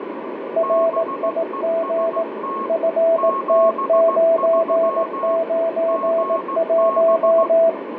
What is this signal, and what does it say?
Morse code, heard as two keyed tones, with radio static and room echo. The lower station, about 18 wpm, 660 Hz: RIG FT991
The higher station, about 16 wpm, 1090 Hz: BEST 73 GB